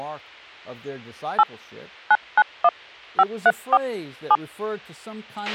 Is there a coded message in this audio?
Yes: DTMF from 1.4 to 4.4 s, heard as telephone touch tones, dialled by machine, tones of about 50 ms, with a squelch burst at the end and speech in English. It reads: 8 991 534 7